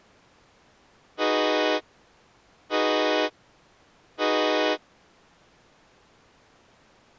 Train horn signal, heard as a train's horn. 3 short. On North American railways: when stopped, the train will back up.